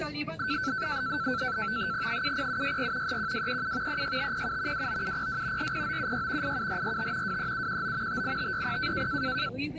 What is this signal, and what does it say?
NAVTEX (SITOR-B), 100 baud, 170 Hz shift, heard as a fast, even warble, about 1430 Hz centre, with the noise inside a car. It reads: 70764 31237 36507 29702 40976 87445 23719 58560